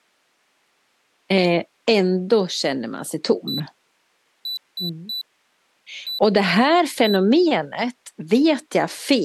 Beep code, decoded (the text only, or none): 1-3-1-1